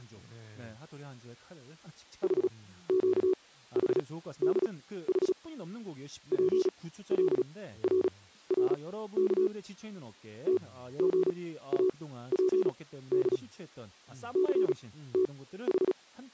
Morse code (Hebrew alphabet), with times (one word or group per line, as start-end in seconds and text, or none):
2.2-5.3 חקחדח
6.3-9.5 פלררך
10.5-13.4 תגאפד
14.4-16.3 …